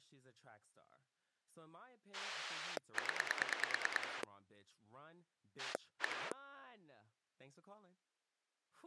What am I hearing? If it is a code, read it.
Pulse dialling, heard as a rotary dial, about 9 pulses a second, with speech in English. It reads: 0 1